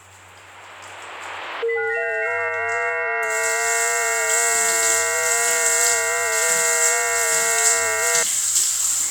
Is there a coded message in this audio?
Yes: FT8 (several signals at once) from 1.6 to 8.2 s, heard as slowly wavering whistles, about 6.25 baud, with the noise of a restroom.